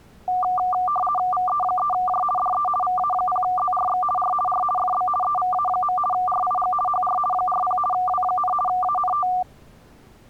RTTY (50 baud, 450 Hz shift), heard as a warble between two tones, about 960 Hz centre. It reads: VE3J DE VA0ZRX R R FB EVA. RIG HR 40 W, ANT